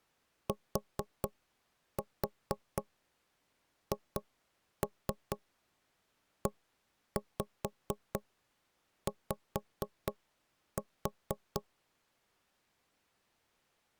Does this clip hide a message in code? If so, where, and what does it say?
Yes: tap code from 0.5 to 11.7 s, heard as knocks on wood, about 4 knocks a second. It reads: THEY